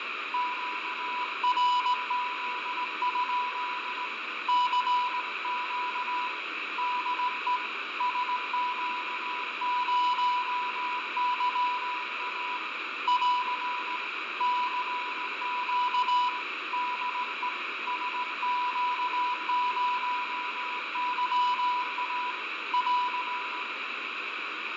Morse code, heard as a keyed tone, hand-sent with a straight key, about 18 wpm, 990 Hz, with radio static, fading and room echo. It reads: QRZ? CQ DE SQ0YA <AR> CQ DE SQ0YA <AR>